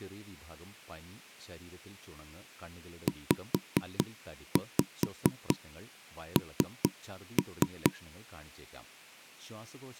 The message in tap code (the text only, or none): ZN